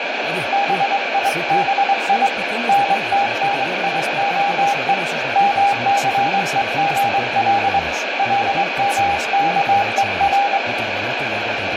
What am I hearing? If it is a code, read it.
Morse code (Hebrew alphabet), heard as a keyed tone, hand-sent with a straight key, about 23 wpm, 800 Hz, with heavy radio static. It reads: ביבי נתניהו מסוגל למכור